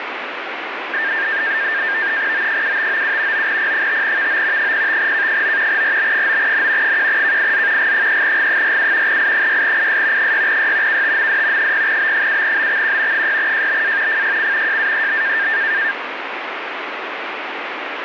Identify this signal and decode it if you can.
NAVTEX (SITOR-B), 100 baud, 170 Hz shift, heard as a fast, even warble, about 1700 Hz centre, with radio static. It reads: O7597 9P5VO 05K9 RB9N 1KIZ G3G47 I6IS 6Y KTMD 0B7BXQ 6JBA FYC JAEB